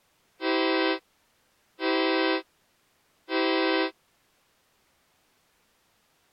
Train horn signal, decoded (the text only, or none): 3 short